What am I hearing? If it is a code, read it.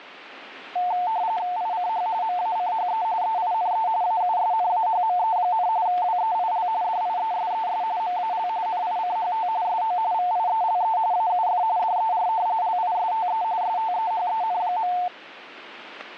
RTTY (45.45 baud, 170 Hz shift), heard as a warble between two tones, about 800 Hz centre. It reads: ICH MACHE EINE AUSNAHME, WEIL DIESES MAL NICHT SO VIELE AUF DER LISTE STEHEN.